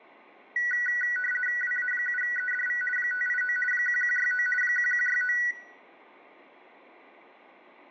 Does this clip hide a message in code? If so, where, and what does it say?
Yes: RTTY (50 baud, 450 Hz shift) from 0.6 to 5.5 s, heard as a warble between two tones, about 1700 Hz centre, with room echo. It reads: WA7EDV 589 1169 1169